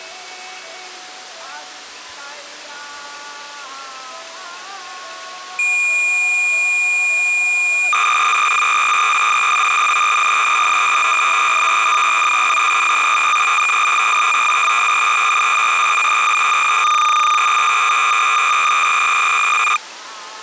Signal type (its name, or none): cassette data (Kansas City type)